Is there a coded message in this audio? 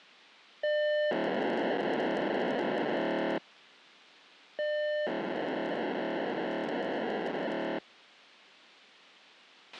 Yes: POCSAG pager data (1200 baud) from 0.6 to 7.8 s, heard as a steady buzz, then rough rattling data, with a squelch burst at the end.